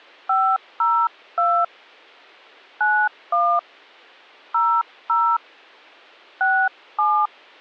DTMF, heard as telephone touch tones, dialled by hand, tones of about 270 ms. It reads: 502 91 00 67